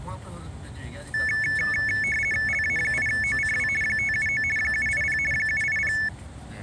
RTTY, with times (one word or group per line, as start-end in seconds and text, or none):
2.5-3.7 LA8OCW
3.8-4.4 579
4.6-5.2 780
5.3-5.9 780